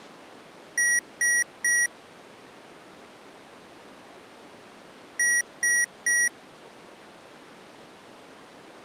Beep code, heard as beeps from a small speaker, played twice, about 1900 Hz. 3 short. In AMI BIOS tables: failure in the first 64 KB of memory; in Dell tables: chipset error.